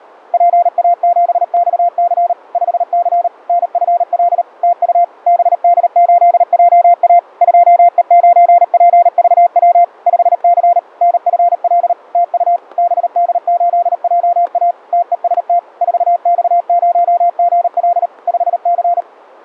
Morse code, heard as a keyed tone, machine-sent, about 38 wpm, 700 Hz, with static crashes. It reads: PA7XC 5C NFL TU BD8JA 2E9PVW 5C NFL TU BD8JA TEST 4X0GL 5C